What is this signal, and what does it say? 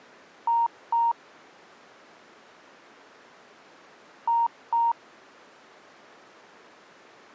Beep code, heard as beeps, played twice, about 930 Hz. 2 short. In AMI BIOS tables: memory parity error; in IBM BIOS tables: self-test error shown on screen; in Dell tables: no memory detected.